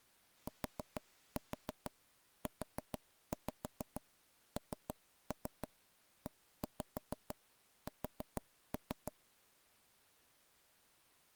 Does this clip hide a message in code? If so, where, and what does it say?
Yes: tap code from 0.5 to 9.1 s, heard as knocks on wood, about 6 knocks a second. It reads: TUNES